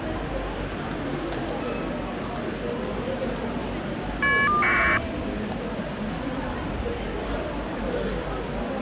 Caller ID data burst, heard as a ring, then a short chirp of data, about 1200 baud, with phone line noise and the noise of a crowd indoors.